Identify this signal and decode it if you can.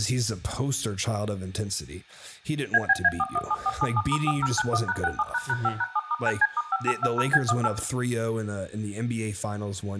DTMF, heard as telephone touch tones, dialled by machine, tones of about 40 ms, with room echo and speech in English. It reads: ABA417477*4091#67##5#7*9C*5820B18